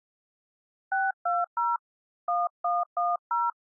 DTMF, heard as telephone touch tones, dialled by hand, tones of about 190 ms. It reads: 620 1110